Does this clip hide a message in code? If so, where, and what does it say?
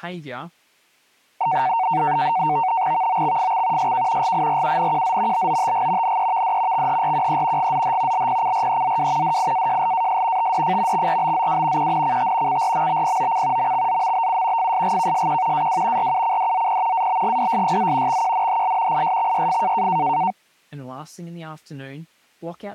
Yes: NAVTEX (SITOR-B), 100 baud, 170 Hz shift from 1.4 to 20.3 s, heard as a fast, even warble, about 830 Hz centre, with speech in English. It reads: VOXFX SK GIRUNQZ BOTG NEVD XHRQE GZH LPCREZW DIAJLAS TDF XRBZW QNCT CRMBPOC MXZMBU FSGKSQ AW RUCDZP ABGDSYZ XQNHL ISXYF